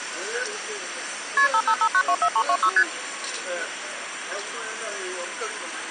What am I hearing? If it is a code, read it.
Multi-frequency trunk signalling (R1, as on North American trunks), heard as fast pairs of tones, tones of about 70 ms, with phone line noise and the noise of a restaurant. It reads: KP 555924326 ST